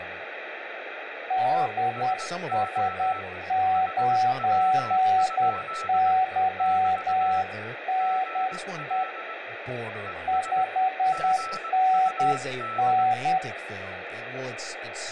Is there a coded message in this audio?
Yes: Morse code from 1.2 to 13.4 s, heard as two keyed tones, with radio static and speech in English. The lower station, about 10 wpm, 750 Hz: DS9YNE 5NN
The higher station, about 20 wpm, 1320 Hz: SO HW? <BT> GL ES GUD